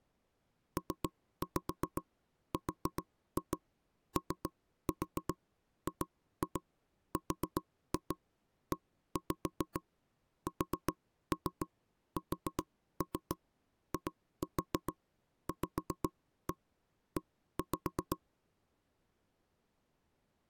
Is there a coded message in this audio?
Yes: tap code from 0.8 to 18.2 s, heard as knocks on wood, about 7 knocks a second. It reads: PROGRESSIVE